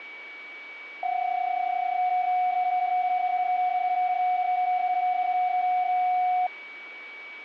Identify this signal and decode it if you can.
PSK31 (31.25 baud), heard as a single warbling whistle, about 730 Hz, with a steady whistle near 2270 Hz.